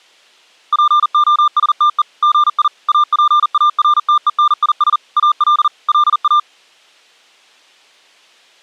Morse code, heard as a keyed tone, machine-sent, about 40 wpm, 1200 Hz. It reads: POSTE GI APARTENIS AL LA